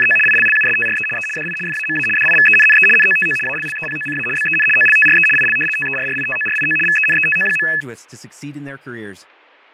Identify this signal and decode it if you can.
RTTY (75 baud, 850 Hz shift), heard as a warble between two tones, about 2150 Hz centre, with fading and speech in Spanish. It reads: … ILLUSTRE E DI FAMA DIVENNE NOTO ALLEPOCA BEN OLTRE IL TERRITORIO VENETO.